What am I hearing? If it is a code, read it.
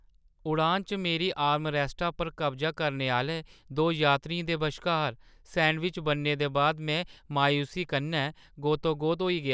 Speech in Dogri. There is no code.